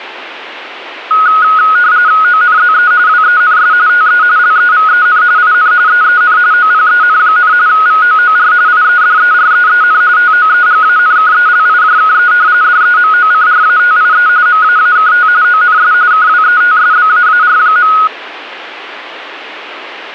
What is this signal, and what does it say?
RTTY (45.45 baud, 170 Hz shift), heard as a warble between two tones, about 1360 Hz centre. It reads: ONZE WENS TE LEVEN IN EEN OPEN, VOOR IEDEREEN TOEGANKELIJKE DEMOCRATIE MAAKT ONS KWETSBAAR.